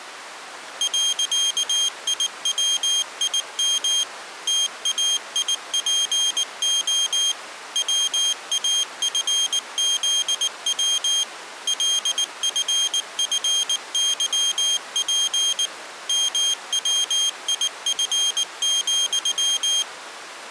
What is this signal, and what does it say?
Morse code, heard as a high beeper, machine-sent, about 19 wpm, 3200 Hz. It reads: .IWIM TAIPO WAFZW LFFYP MWIF,